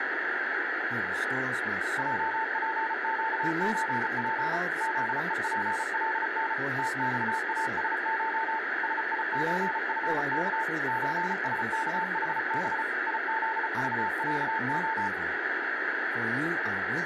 Morse code (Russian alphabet), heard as a keyed tone, machine-sent, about 34 wpm, 890 Hz, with radio static. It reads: ЙПЩЧП ЗЕПЛН ТЬАСШ СИЧФК ЧСКХБ ИЗЖЯО